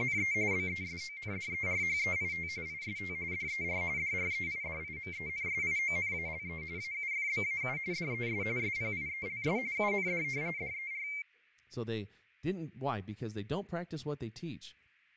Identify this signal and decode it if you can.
RTTY (45.45 baud, 170 Hz shift), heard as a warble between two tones, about 2200 Hz centre, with fading and speech in English. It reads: … BESONDERHEIT IST DER DREIDIMENSIONALE AUFBAU DES SPIELS UND DER